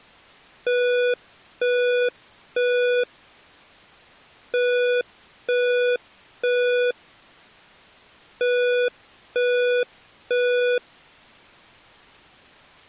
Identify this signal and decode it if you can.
Alarm pattern, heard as an alarm's beeps, played three times, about 490 Hz. Temporal three. Smoke or fire, evacuate.